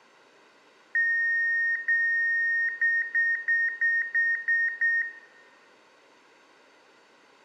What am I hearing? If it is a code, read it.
Beep code, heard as beeps, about 1850 Hz, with room echo. 2 long, 7 short.